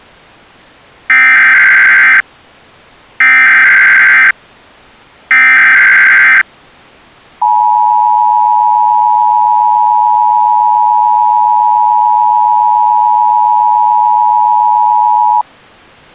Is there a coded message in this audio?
Yes: Emergency Alert System (SAME) tones (header bursts, then the 853 and 960 Hz attention tone) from 1.1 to 15.4 s, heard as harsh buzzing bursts, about 520.83 baud.